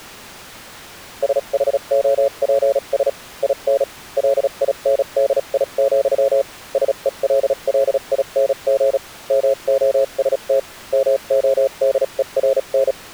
Morse code, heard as a keyed tone, machine-sent, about 36 wpm, spaced as for 31 wpm, 550 Hz. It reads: SHOPS IN LINDI, SELLING MOST MODERN